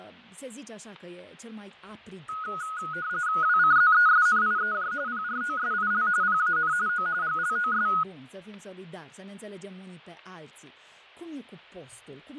RTTY (45.45 baud, 170 Hz shift), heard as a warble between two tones, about 1360 Hz centre, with fading. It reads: WCZESNIEJ PROSIL PAN O GLOS